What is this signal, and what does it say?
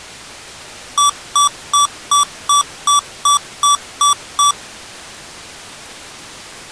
Beep code, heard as beeps from a small speaker, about 1150 Hz. 10 short. In AMI BIOS tables: CMOS shutdown register error.